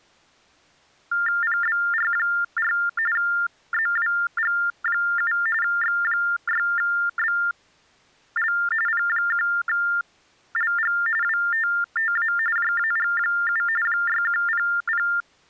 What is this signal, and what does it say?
TTY/TDD text telephone tones (45.45 baud Baudot), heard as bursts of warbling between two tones, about 400 Hz shift, 1600 Hz centre. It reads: PBR4 ZWG7 X6BL P1LG WTTA JAG7 6100